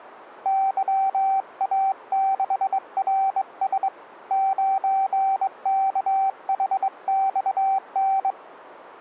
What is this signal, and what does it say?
Morse code, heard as a keyed tone, hand-sent with a straight key, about 22 wpm, 770 Hz. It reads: YA6RS 9KHXN